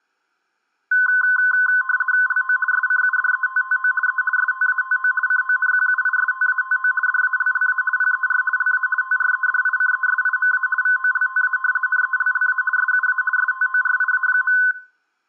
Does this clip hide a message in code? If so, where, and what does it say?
Yes: RTTY (50 baud, 450 Hz shift) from 0.9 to 14.7 s, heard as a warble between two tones, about 1270 Hz centre. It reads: LO SCUDETTO E STATO CONQUISTATO DALLA PER LA TREDICESIMA VOLTA NELLA SUA STORIA.